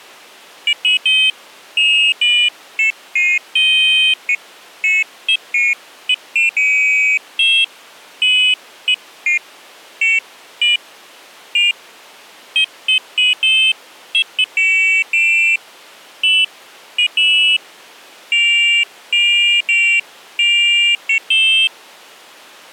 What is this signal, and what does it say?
Pairs of high tones at irregular times. There is no code.